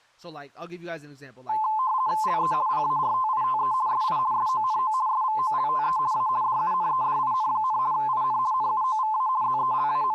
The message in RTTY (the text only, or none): LE PARTITE SI SONO SVOLTE A DUNEDIN, IN NUOVA …